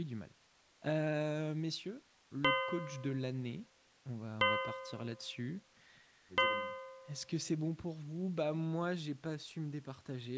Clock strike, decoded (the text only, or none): 3